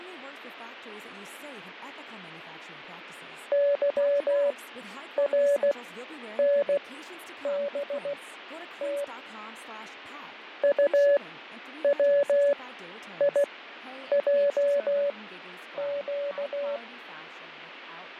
Morse code, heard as a keyed tone, machine-sent, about 16 wpm, spaced as for 9 wpm, 570 Hz, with radio static, fading and speech in English. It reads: YRNBT UWIJQ